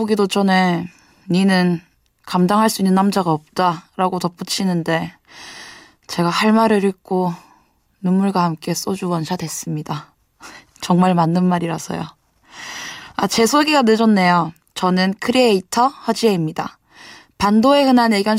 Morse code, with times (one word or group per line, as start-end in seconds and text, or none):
none